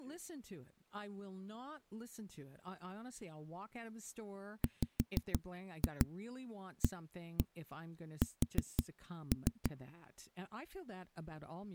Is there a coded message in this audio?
Yes: tap code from 4.6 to 9.7 s, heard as knocks on a wall, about 6 knocks a second, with speech in English. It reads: WAS